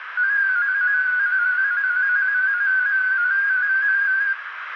Multi-tone FSK (Olivia or MFSK type), about 250 Hz wide, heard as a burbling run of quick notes, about 15.625 baud, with radio static, a narrow filter and room echo.